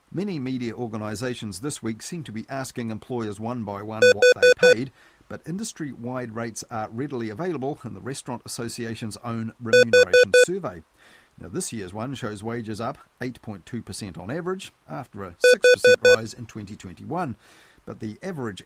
Alarm pattern, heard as an alarm's beeps, played three times, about 500 Hz, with speech in English. Temporal four. Carbon monoxide.